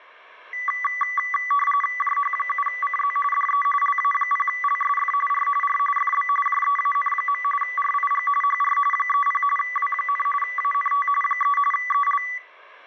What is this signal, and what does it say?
RTTY (45.45 baud, 850 Hz shift), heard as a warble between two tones, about 1550 Hz centre. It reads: JH7CZ DE LA0LSF R R FB JEAN. RIG HR 30 W, ANT 3 EL